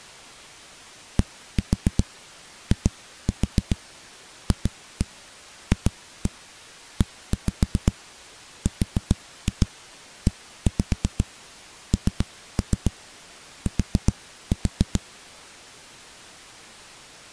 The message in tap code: DIFFERENT

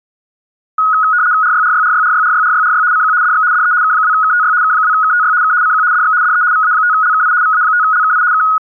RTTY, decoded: RYRYRYRYRYRYRY CQ DX DE K2KTY K2KTY K CQ DX DE VA5LKI VA5LKI K

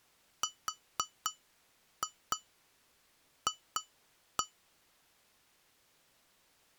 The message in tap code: RF

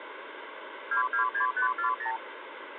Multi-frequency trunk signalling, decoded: 226540

